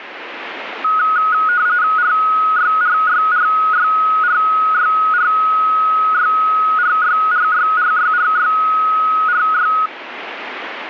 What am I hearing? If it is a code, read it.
RTTY (45.45 baud, 170 Hz shift), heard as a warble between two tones, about 1360 Hz centre, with radio static. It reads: RYRYRYRYRYRYRYRYRYRY